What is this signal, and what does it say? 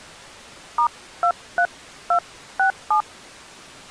DTMF, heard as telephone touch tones, dialled by hand, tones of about 80 ms. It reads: *23267